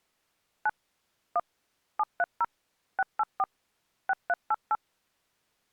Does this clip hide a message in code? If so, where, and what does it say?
Yes: DTMF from 0.7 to 4.8 s, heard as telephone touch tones, dialled by machine, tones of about 40 ms. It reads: 9 1 730 684 6388